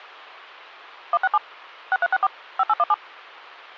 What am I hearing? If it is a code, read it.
DTMF, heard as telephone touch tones, dialled by machine, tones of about 40 ms. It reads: 167 6364 5817